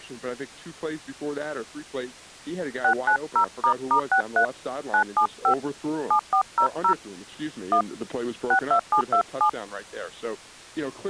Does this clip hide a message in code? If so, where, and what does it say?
Yes: DTMF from 2.8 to 9.5 s, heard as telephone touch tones, dialled by hand, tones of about 90 ms. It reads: 690**63 975 7400 1 62727